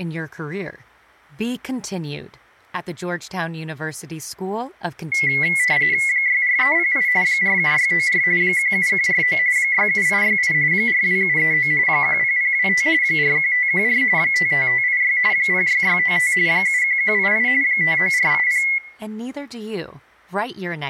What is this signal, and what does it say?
RTTY (45.45 baud, 170 Hz shift), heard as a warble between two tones, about 2050 Hz centre, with room echo and speech in English. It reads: 64308 47694 17149 67868 42739 10025 41514 55586 06695 71188 59480